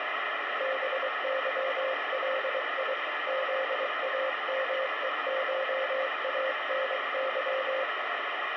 Morse code (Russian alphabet), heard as a keyed tone, hand-sent with a paddle, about 23 wpm, 530 Hz, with radio static. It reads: БЫЛИ ЗАМЕШАНЫ